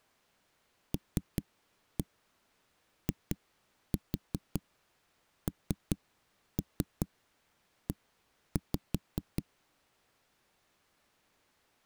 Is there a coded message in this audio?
Yes: tap code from 0.9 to 9.4 s, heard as knocks on a wall, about 5 knocks a second. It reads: LINE